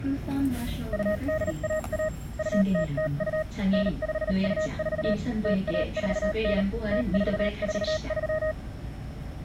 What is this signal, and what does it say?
Morse code (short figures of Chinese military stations), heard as a keyed tone, machine-sent, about 38 wpm, spaced as for 33 wpm, 620 Hz, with the noise inside a bus. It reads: 2811 2002 9524 0149 0443